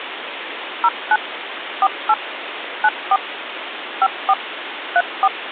DTMF, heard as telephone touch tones, dialled by machine, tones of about 50 ms, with phone line noise. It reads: 09 48 94 54 34